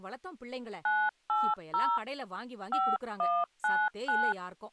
DTMF, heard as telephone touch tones, dialled by hand, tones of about 240 ms, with speech in Tamil. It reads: 980 5199